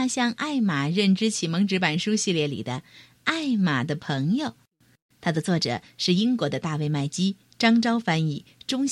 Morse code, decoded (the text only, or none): none